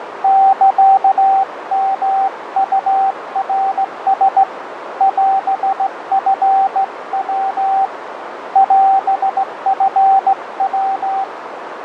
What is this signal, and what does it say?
Morse code (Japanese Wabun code), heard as a keyed tone, hand-sent with a straight key, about 16 wpm, 780 Hz, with radio static, fading and a narrow filter. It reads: サヨウナラ オチヤ オチヤ